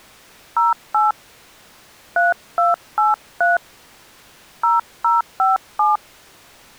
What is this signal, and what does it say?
DTMF, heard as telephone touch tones, dialled by hand, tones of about 160 ms. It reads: 08 3283 0057